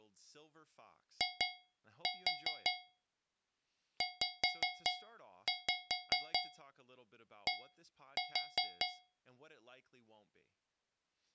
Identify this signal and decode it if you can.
Tap code, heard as taps on a metal pipe, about 5 knocks a second, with speech in English. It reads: IZD